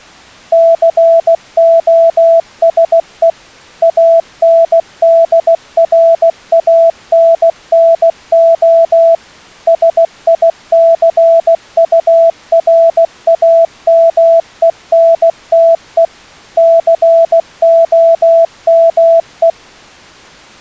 Morse code, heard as a keyed tone, machine-sent, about 16 wpm, 660 Hz. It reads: COSE ANDRANNO SICURAMENTE COME